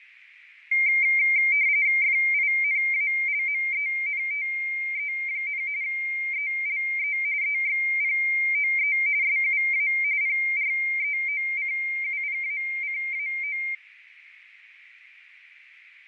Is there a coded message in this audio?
Yes: RTTY (45.45 baud, 170 Hz shift) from 0.7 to 13.7 s, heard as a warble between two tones, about 2200 Hz centre, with radio static, fading and a narrow filter. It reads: FINALMENTE, ELE EXPOE SUA PREOCUPACAO